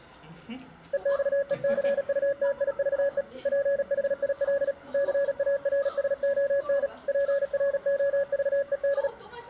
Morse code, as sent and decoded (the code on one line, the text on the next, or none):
. -..- . -.-. ..- - .. ...- . / .--. .... .. .-.. / -.-. .- .-. ... --- -. / .--. .-. --- ...- . -..
EXECUTIVE PHIL CARSON PROVED